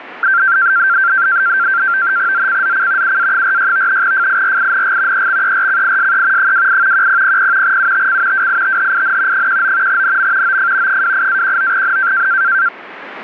NAVTEX (SITOR-B), 100 baud, 170 Hz shift, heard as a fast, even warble, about 1470 Hz centre, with radio static. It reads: ZCZC UA46 FIRING EXERCISE 28 1000 UTC WITHIN 19 NM OF 28-19N